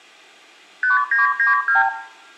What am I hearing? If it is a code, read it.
Multi-frequency trunk signalling (R2, with the far end's replies), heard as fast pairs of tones, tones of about 140 ms, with room echo. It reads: 5992